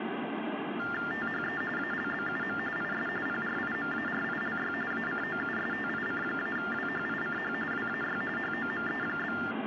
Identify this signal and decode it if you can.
TTY/TDD text telephone tones (45.45 baud Baudot), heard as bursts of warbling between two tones, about 400 Hz shift, 1600 Hz centre, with phone line noise. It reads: THE ALBUM IS PRIMARILY ACOUSTIC-WHICH WAY HOME?